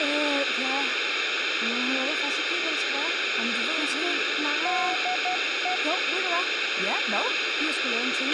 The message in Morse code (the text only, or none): DE